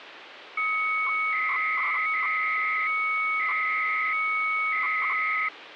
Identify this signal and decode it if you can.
300-baud modem data (Bell 103 tones), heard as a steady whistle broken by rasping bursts, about 300 baud, 200 Hz shift, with phone line noise.